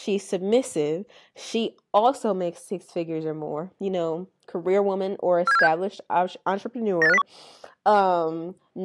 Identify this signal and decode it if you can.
Five-tone selective call (EEA), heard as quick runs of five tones, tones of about 40 ms, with speech in English. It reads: 47476 98501